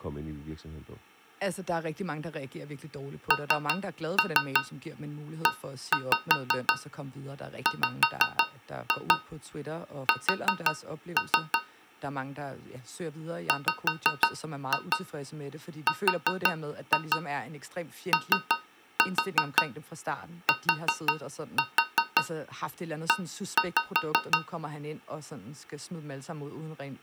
Tap code, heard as taps on a metal pipe, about 5 knocks a second, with speech in Danish. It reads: NEWS WROTE